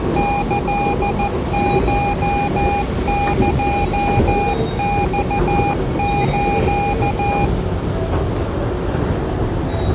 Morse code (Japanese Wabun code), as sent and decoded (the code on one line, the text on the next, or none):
-.-.. ---- -.--- -..- ---.-
キコエマス